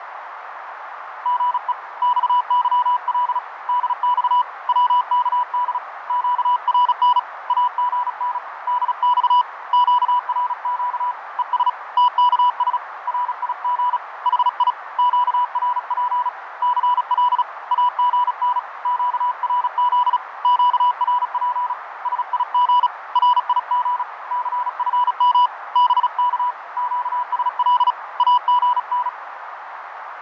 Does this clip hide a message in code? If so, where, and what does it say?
Yes: Morse code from 1.2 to 29.2 s, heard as a keyed tone, hand-sent with a paddle, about 36 wpm, 980 Hz, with radio static, fading and a narrow filter. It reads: GE XYL DX WKD QRN AGN DX QRQ ES TKS RIG HI QRP CL AGN QRZ QRP SIG RIG CFM BK QSL AGN